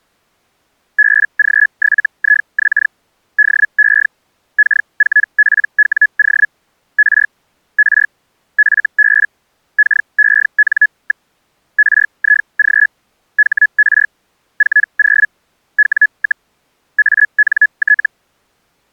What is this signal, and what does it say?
Hellschreiber (Feld-Hell, 122.5 baud), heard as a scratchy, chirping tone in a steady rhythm, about 1700 Hz. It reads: BG7IX DE K4PWO R R FB KEN. RIG HR 40 W, ANT